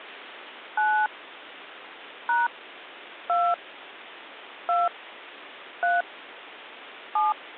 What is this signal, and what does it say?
DTMF, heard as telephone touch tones, dialled by hand, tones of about 200 ms, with phone line noise. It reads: 9 # 2 2 3 7